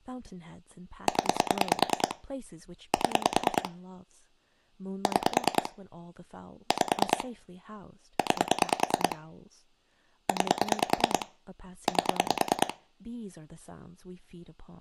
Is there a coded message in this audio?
Yes: pulse dialling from 1.1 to 12.7 s, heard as clicks on a phone line, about 9 pulses a second, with speech in English. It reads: 0 7 6 5 9 9 8